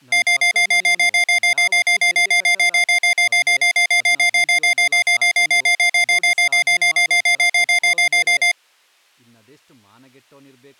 Evenly repeated beeps, with speech in Kannada. There is no code.